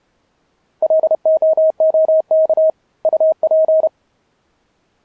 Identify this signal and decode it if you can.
Morse code, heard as a keyed tone, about 31 wpm, 630 Hz. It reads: LOOK UP